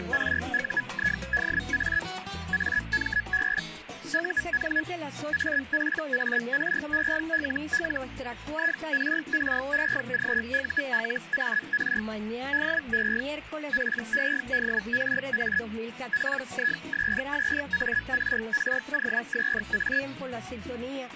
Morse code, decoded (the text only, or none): none